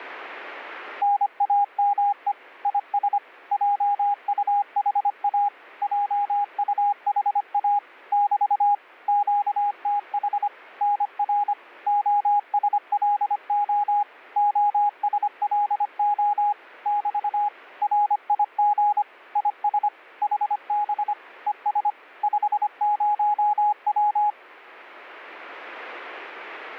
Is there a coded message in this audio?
Yes: Morse code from 1.0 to 24.4 s, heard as a keyed tone, machine-sent, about 25 wpm, 820 Hz. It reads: NAME IS JUHA JUHA <BT> QTH NR OSLO OSLO <BT> RIG IS HB ES 50W